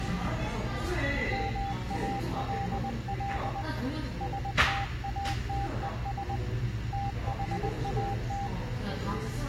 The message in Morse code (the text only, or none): MALL STATES THAT